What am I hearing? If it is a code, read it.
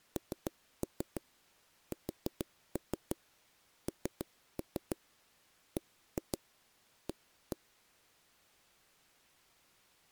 Tap code, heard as taps on a table, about 6 knocks a second. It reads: NSNBA